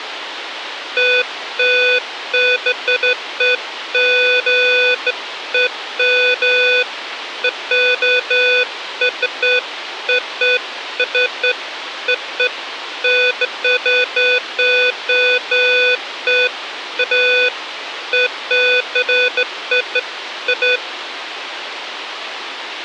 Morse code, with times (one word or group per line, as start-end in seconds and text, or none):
none